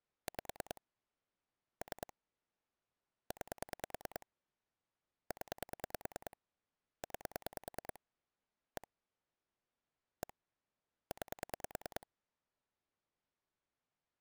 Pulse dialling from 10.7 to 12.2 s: 9

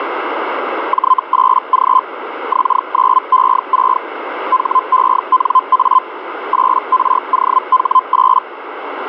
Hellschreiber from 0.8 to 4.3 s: J8G X9E6

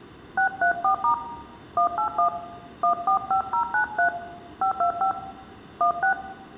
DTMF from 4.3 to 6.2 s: 525 16

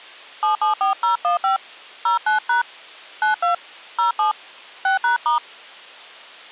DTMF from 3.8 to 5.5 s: 07 6#*

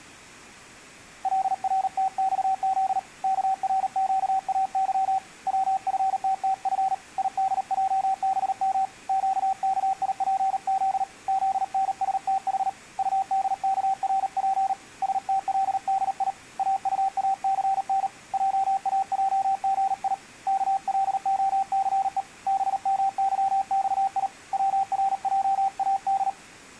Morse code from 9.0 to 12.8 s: QKIPZ ZNSTH

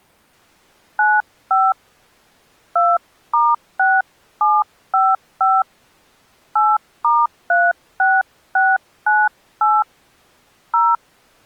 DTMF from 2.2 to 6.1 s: 2*6755

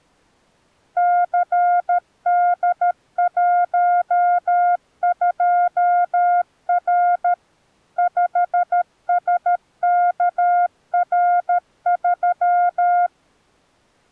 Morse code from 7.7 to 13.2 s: 5SKR3

